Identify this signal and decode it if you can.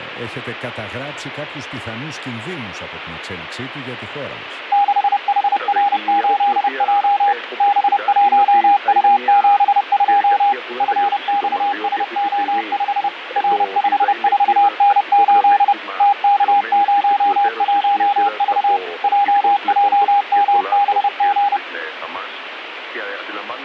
Morse code, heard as a keyed tone, machine-sent, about 30 wpm, 810 Hz, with radio static and fading. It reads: 6HR8J B1U72 FXSO5 R54N8 TK01V JJMBG